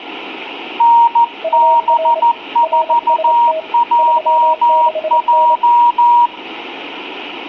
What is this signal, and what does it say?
Morse code, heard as two keyed tones, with room echo. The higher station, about 14 wpm, 950 Hz: NB4JJ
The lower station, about 27 wpm, 640 Hz: UR RST 36N